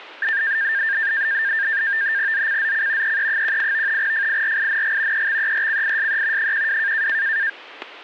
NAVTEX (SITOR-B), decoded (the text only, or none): ZCZC EE18 FIRING EXERCISE 12